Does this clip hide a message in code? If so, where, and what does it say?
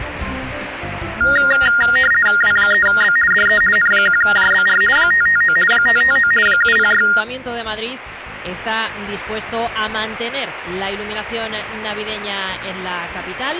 Yes: RTTY (50 baud, 450 Hz shift) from 1.2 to 7.2 s, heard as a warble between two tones, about 1650 Hz centre. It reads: W3B DE N1JBR 559 559 706